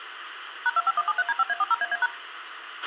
DTMF, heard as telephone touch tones, dialled by machine, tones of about 40 ms, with radio hiss and a squelch burst at the end. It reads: #25173D5A40AA#